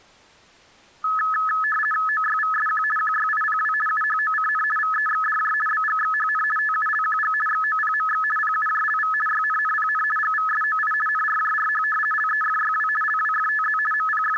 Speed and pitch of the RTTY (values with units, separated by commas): 50 baud, 450 Hz shift, 1500 Hz centre